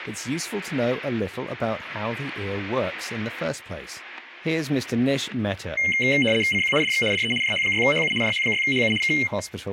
RTTY (75 baud, 850 Hz shift), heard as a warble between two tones, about 2550 Hz centre, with static crashes. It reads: CQ DX DE JH6HU JH6HU K